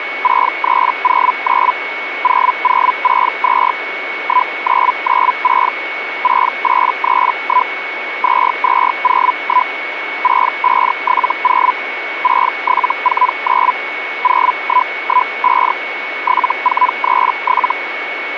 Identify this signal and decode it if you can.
Hellschreiber (Feld-Hell, 122.5 baud), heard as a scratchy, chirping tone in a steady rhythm, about 1000 Hz, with radio static and a steady whistle near 2220 Hz. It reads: 6309 0062 1996 6831 2201 6570 6749 0115 7437